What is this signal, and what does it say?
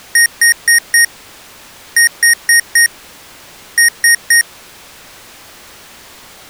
Beep code, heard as beeps from a small speaker, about 1850 Hz. 4-4-3. In Phoenix BIOS tables: maths coprocessor failure.